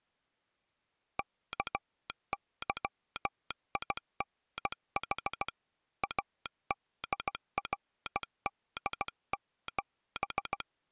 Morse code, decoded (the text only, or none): KYINH ADRD7